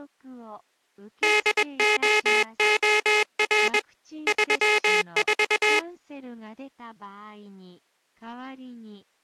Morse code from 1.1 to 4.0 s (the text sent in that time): DOOR